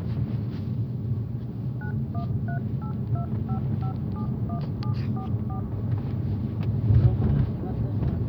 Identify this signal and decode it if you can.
DTMF, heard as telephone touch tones, dialled by machine, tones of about 100 ms, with the noise inside a car. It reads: 913825571744